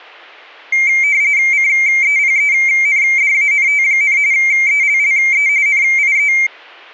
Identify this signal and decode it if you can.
RTTY (45.45 baud, 170 Hz shift), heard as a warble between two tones, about 2200 Hz centre. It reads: CEPENDANT, ELLE NIE